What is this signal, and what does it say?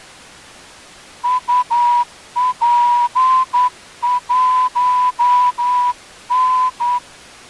Morse code, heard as a whistle, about 10 wpm. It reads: UP1N